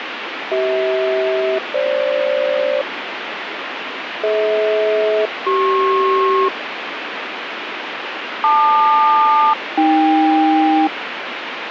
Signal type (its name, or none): aircraft SELCAL